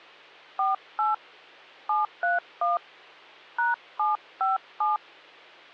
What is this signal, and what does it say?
DTMF, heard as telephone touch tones, dialled by hand, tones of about 160 ms, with hum. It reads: 48 731 #757